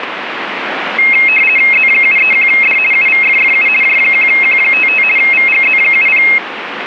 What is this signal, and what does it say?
RTTY (50 baud, 450 Hz shift), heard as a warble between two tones, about 2350 Hz centre, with radio static. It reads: Z731D UVFFU J1Q55 VGZ70